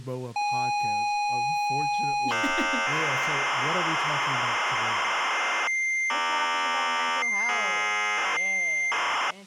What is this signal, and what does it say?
ZX Spectrum tape loading, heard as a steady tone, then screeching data, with speech in English.